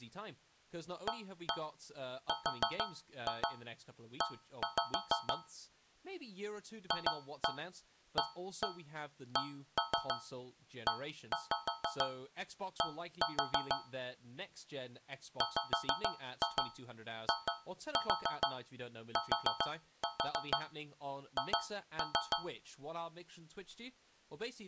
Tap code, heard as taps on a metal pipe, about 6 knocks a second, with speech in English. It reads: ARE FACED WITH